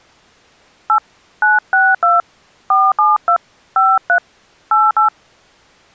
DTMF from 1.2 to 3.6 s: 962 472

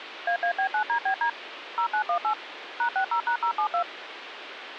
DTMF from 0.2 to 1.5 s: AAB9DBD

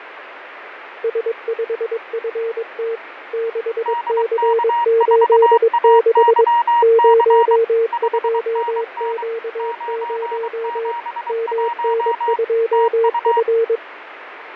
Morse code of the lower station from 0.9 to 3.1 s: S5FT

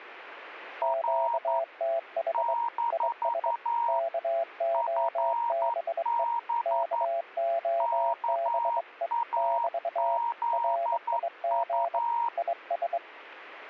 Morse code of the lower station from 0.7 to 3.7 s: QTH IS

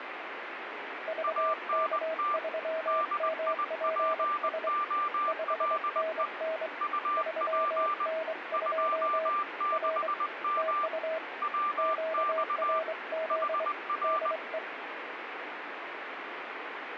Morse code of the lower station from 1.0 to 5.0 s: VK3MPS

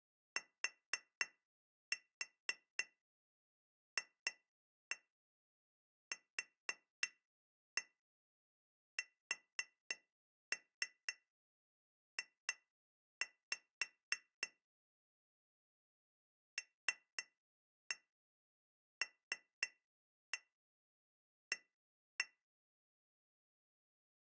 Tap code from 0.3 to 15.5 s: TFQSJ

